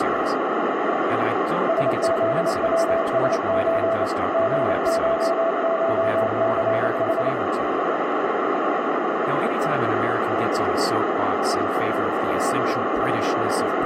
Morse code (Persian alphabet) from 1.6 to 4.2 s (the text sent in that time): سزوسچ